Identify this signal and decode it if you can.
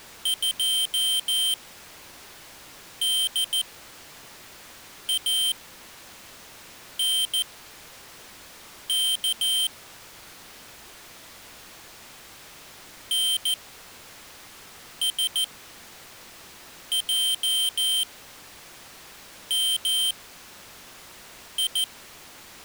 Morse code, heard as a high beeper, machine-sent, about 14 wpm, spaced as for 5 wpm, 3150 Hz. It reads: 2DANK NSJMI